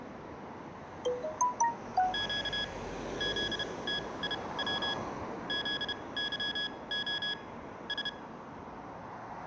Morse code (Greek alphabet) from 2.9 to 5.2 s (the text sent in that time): ΖΤΙΩ